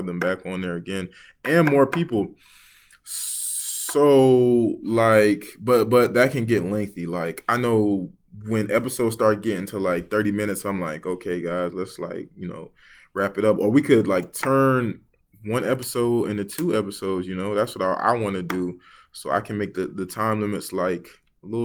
Speech in English. There is no code.